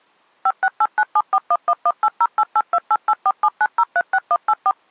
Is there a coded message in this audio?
Yes: DTMF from 0.5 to 4.7 s, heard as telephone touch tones, dialled by machine, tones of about 50 ms. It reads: 5689741118088288479036184